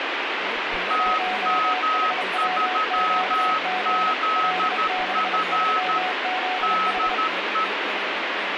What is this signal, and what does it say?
Morse code, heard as two keyed tones, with radio static and speech in Dogri. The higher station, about 13 wpm, 1280 Hz: TM3ZF DE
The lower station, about 30 wpm, 740 Hz: 1HWQG L63ZH